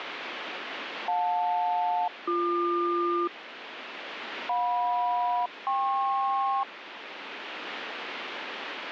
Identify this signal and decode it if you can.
Aircraft SELCAL, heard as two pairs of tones, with radio static. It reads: JL-BQ JM-KP